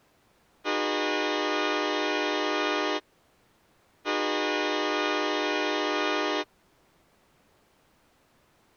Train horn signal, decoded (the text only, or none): 2 long